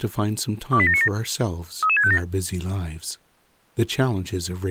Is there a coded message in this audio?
Yes: five-tone selective call (ZVEI) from 0.7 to 2.2 s, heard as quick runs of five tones, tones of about 70 ms, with speech in English. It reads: 28797 33657